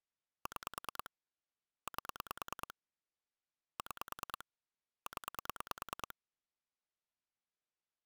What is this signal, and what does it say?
Pulse dialling, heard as clicks on a phone line, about 9 pulses a second. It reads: 6 8 6 0